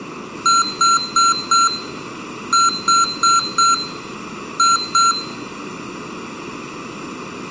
Beep code, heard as beeps from a small speaker, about 1360 Hz, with room echo. 4-4-2. In Phoenix BIOS tables: parallel port failure.